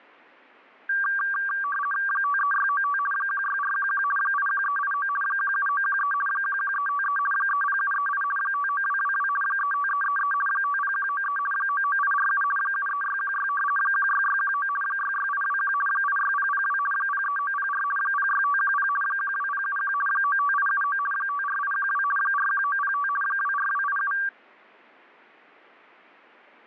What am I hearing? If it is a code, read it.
RTTY (50 baud, 450 Hz shift), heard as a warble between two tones, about 1370 Hz centre. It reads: 53695 16411 81389 17913 11353 30738 59222 35333 50193 99847 73616 16619 66821 86002 03904 06510 12071 95879 54812 41905 24287